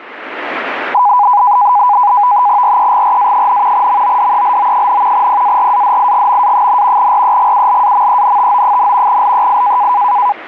NAVTEX (SITOR-B), 100 baud, 170 Hz shift, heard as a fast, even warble, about 910 Hz centre, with radio static. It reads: REGRA, MODELO, PARADIGMA, REGULAMENTO, LEI